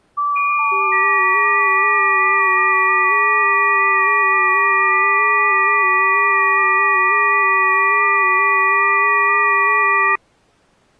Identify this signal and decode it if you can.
FT8 (several signals at once), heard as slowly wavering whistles, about 6.25 baud.